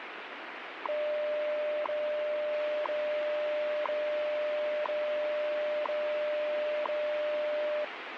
Radio time signal (WWV, Colorado), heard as ticks, one a second, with radio static.